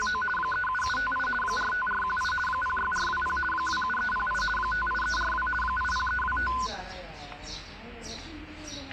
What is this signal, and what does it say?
RTTY (50 baud, 450 Hz shift), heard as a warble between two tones, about 1250 Hz centre, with static crashes and the noise of a residential street. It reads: … 37758 45418 06420 27308 58342 80325